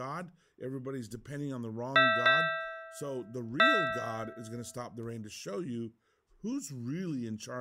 Ship's bell, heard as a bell, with speech in English. 3. Three half-hours of the watch have passed.